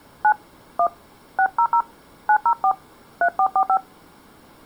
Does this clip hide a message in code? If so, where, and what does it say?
Yes: DTMF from 0.2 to 3.8 s, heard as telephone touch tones, dialled by hand, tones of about 80 ms. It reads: 9 1 600 904 3445